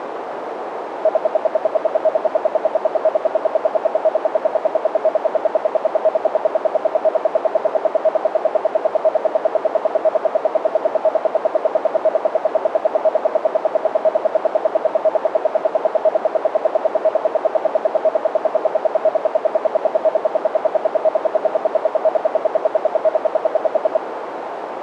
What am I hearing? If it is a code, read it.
Radio time signal (RWM, Moscow), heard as ten pulses a second, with radio static and a narrow filter.